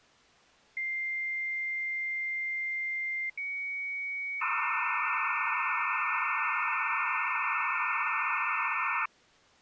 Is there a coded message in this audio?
Yes: dial-up modem handshake (low-speed, two carriers) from 0.8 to 9.1 s, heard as two whistles, then hiss.